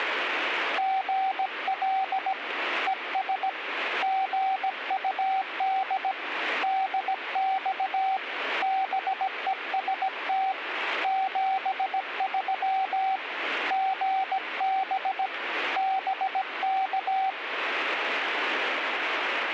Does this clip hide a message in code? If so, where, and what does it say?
Yes: Morse code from 0.7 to 17.4 s, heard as a keyed tone, hand-sent with a paddle, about 17 wpm, 770 Hz, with radio static. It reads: GL ES GUD DX BEST 73 GB BK